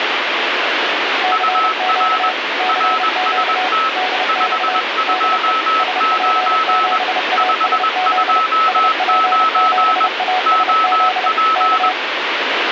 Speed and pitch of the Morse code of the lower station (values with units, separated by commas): 30 wpm, 740 Hz